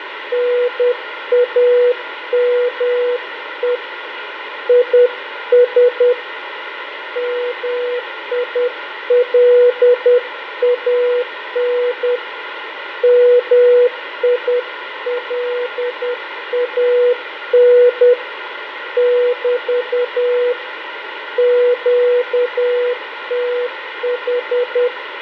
Morse code, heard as a keyed tone, hand-sent with a paddle, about 10 wpm, 490 Hz, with radio static, fading and room echo. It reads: NAME IS MILAN MILAN <BT> QTH